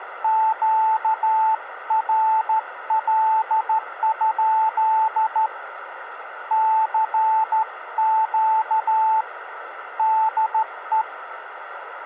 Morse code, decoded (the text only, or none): QRL? CQ DE